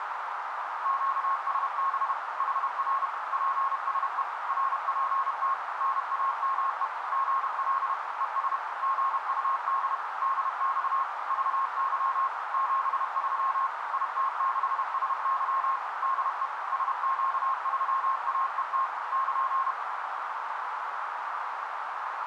Morse code, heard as a keyed tone, machine-sent, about 31 wpm, 1080 Hz, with heavy radio static and a narrow filter. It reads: QSB HR PSE RPT NAME GL ES GUD DX VY 73 IT6SY DE SQ3AET <KN>